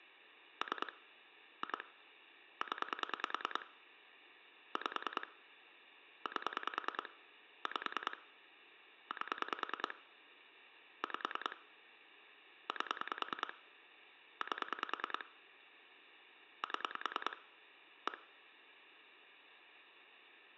Pulse dialling, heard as clicks on a phone line, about 10 pulses a second. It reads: 3 2 0 5 8 5 8 5 8 8 7 1